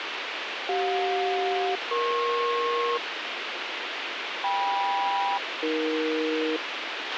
Aircraft SELCAL, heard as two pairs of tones, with radio hiss and a squelch burst at the end. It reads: CJ-EP KM-AE